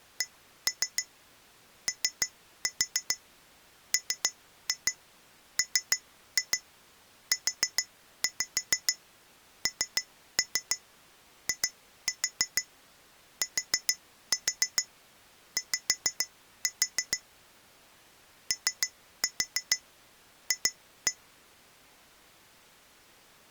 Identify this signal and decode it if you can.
Tap code, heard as taps on glass, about 6 knocks a second. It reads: COMMUNITY OF